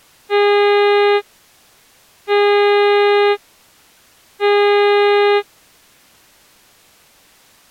Ship horn signal, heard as a ship's horn, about 410 Hz. 3 short. At sea: I am operating astern propulsion.